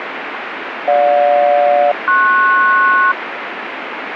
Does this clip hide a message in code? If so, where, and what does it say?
Yes: aircraft SELCAL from 0.9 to 3.1 s, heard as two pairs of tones, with radio static. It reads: GJ-PS